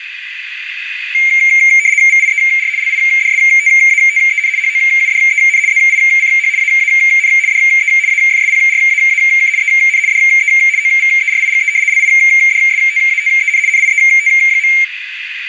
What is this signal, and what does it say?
RTTY (75 baud, 170 Hz shift), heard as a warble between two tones, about 2200 Hz centre, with radio static and a narrow filter. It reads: VIER LIDSTATEN HOUDEN ZICH AAN DE AFSPRAAK EN DE OVERIGE LIDSTATEN NIET.